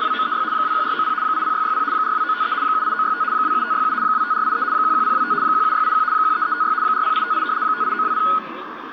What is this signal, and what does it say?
RTTY (75 baud, 170 Hz shift), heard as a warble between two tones, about 1360 Hz centre, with radio static, a narrow filter, room echo and the noise of a park. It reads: … 21490 80660 42953 78965 27567 25483 11025 17681 13356 40858 58920